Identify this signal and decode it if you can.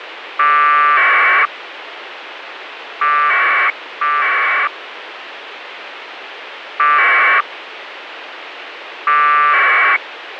Packet radio (AX.25, as in APRS), 1200 baud, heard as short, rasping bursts, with radio hiss.